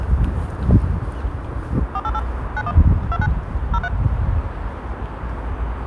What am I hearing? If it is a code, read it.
DTMF, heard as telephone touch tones, dialled by machine, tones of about 50 ms, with the noise of a residential street. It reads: 488 91 29 03